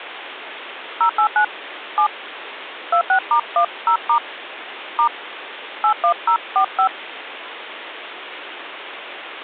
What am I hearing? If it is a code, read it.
DTMF, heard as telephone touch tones, dialled by hand, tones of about 90 ms, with phone line noise. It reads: 089 7 26*10* * 81045